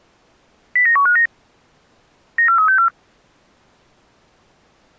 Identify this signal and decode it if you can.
Five-tone selective call (CCIR), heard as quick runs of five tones, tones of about 100 ms. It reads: 09159 94364